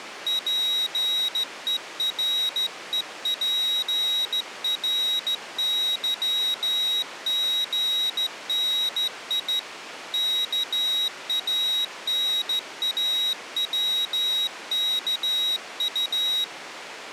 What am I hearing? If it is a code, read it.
Morse code (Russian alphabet), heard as a high beeper, hand-sent with a straight key, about 14 wpm, 3800 Hz. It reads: ПЕРЕПРЫГНИ КАНАВКУ